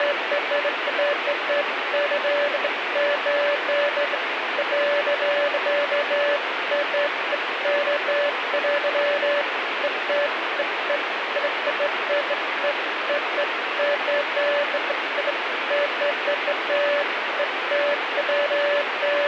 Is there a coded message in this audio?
No, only beeps of irregular length, with radio static.